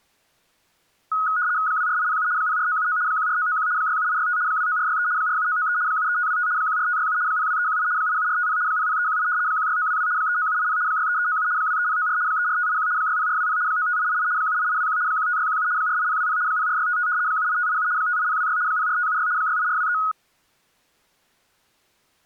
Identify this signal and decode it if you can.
RTTY (75 baud, 170 Hz shift), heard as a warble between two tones, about 1360 Hz centre. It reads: 24807 04979 14991 67865 29463 47993 73525 14567 02318 87450 00318 16922 39780 63397 23094 34581 60420 95888 78821 15617 48020 04655 78587 58026 04576 68423